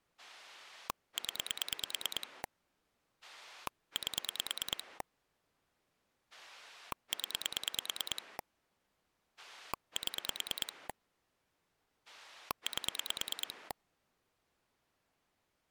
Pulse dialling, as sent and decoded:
10 / 8 / 10 / 7 / 8
0 8 0 7 8

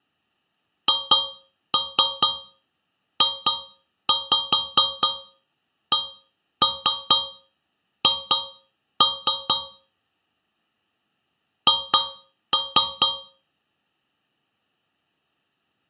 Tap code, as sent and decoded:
2-3 2-5 1-3 2-3 / 2-3
HJCH H

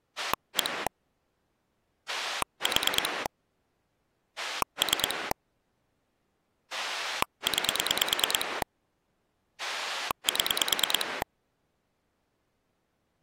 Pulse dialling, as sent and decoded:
1 / 4 / 3 / 9 / 7
1 4 3 9 7

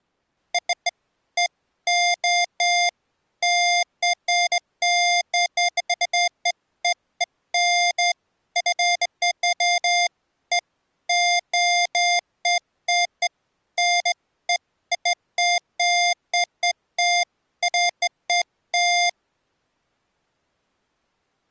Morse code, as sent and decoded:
none

